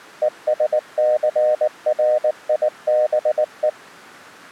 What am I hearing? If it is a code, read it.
Morse code, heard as a keyed tone, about 19 wpm, 610 Hz. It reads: ESCRIBE